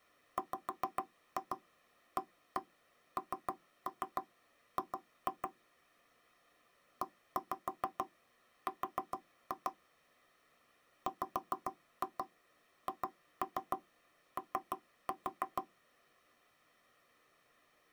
Tap code, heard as knocks on wood, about 6 knocks a second. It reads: WANG ER WHO